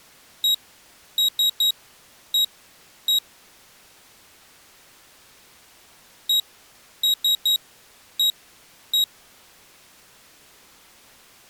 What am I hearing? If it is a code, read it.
Beep code, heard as a piezo beeper, played twice, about 3800 Hz. 1-3-1-1. In Phoenix BIOS tables: memory refresh test failure.